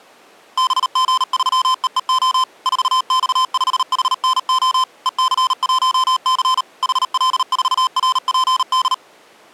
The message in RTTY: none

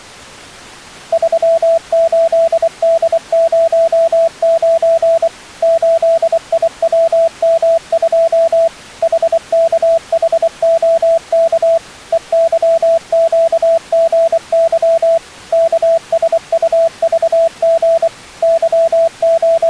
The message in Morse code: 38D09 8IWM2 HKHOK EYQGY KSUVG …

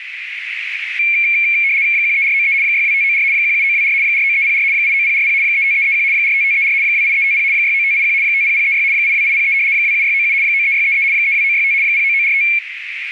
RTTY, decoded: 13493 62594 17924 49304 89040 35331 45534 28350 69581 50036 82803 27697 93633 32965 09945

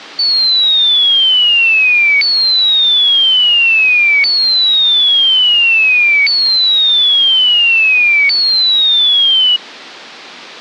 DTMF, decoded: none

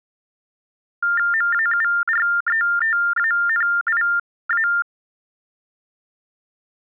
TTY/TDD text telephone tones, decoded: MAURETANIA

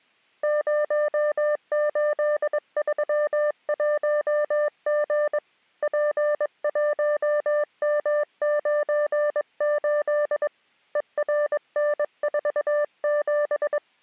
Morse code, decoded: 0831G P1M98 ERN47

